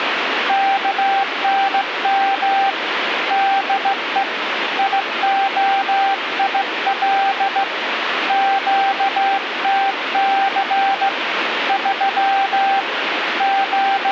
Morse code, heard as a keyed tone, hand-sent with a straight key, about 16 wpm, 780 Hz, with radio static. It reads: KNM DE IOIL QTC 3 …